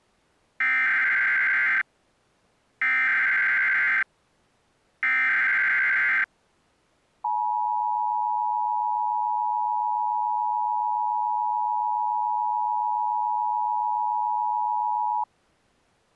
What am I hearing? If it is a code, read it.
Emergency Alert System (SAME) tones (header bursts, then the 853 and 960 Hz attention tone), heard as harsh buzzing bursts, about 520.83 baud.